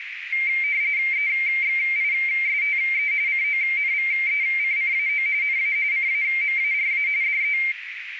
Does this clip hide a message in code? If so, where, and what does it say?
Yes: RTTY (45.45 baud, 170 Hz shift) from 0.3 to 7.7 s, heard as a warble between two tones, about 2200 Hz centre, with radio static and a narrow filter. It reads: EXISTE CONVECCAO NA CAMARA DE